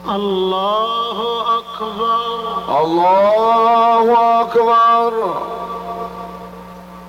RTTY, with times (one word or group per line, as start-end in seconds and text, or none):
none